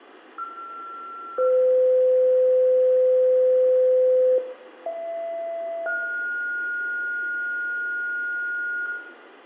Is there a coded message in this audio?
Yes: two-tone page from 0.4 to 8.9 s, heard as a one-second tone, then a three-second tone, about 1360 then 510 Hz, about 670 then 1430 Hz, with room echo.